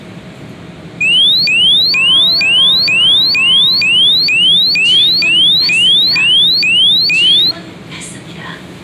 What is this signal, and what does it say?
A tone that sweeps in pitch again and again, with the noise inside a subway train. There is no code.